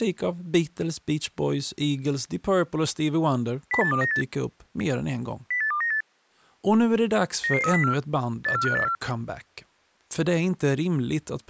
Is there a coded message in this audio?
Yes: five-tone selective call (CCIR) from 3.7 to 9.0 s, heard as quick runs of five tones, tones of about 100 ms, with speech in Swedish. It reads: 08298 08298 99304 84584